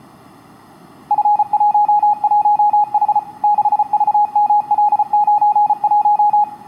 Morse code, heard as a keyed tone, machine-sent, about 34 wpm, 830 Hz, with room echo. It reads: F11H 6VML91